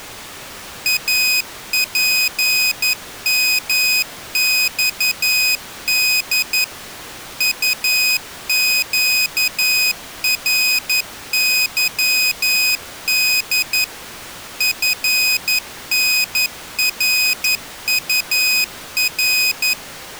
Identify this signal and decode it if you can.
Morse code, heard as a high beeper, machine-sent, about 11 wpm, 2500 Hz. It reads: APMXD UQRYD FNRUR